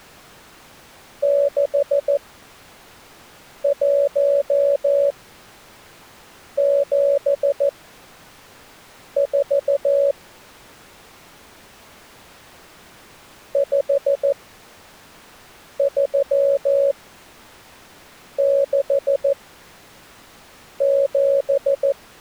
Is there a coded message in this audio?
Yes: Morse code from 1.2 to 22.0 s, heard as a keyed tone, machine-sent, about 14 wpm, spaced as for 5 wpm, 560 Hz. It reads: 6174 5367